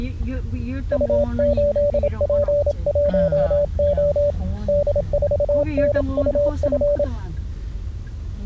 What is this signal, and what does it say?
Morse code, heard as a keyed tone, hand-sent with a paddle, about 27 wpm, 580 Hz, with the noise inside a car. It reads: U8P1O D4NUF